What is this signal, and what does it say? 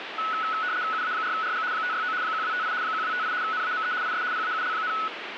RTTY (75 baud, 170 Hz shift), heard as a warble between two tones, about 1380 Hz centre, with radio static. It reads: UA4RG 569 1258 1258 NAME IS PAUL,